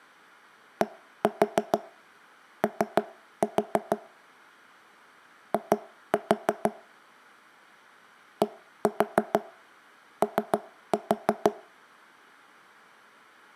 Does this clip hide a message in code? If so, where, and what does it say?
Yes: tap code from 0.8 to 11.6 s, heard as knocks on wood, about 6 knocks a second, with room echo. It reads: DO I DO